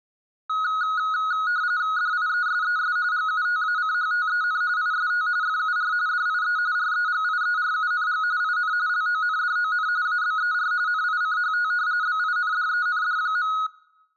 RTTY (45.45 baud, 170 Hz shift), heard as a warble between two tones, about 1360 Hz centre. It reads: DIESES GUTACHTEN IST FUR DIE REGIERUNG IN LONDON ABER NICHT BINDEND.